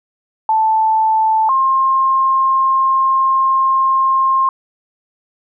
Two-tone page, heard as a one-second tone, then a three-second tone, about 880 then 1060 Hz.